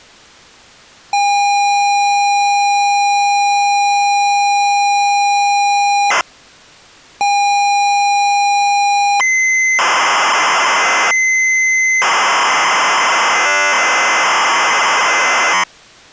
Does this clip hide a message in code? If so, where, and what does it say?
Yes: ZX Spectrum tape loading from 1.1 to 15.6 s, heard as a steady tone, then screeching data.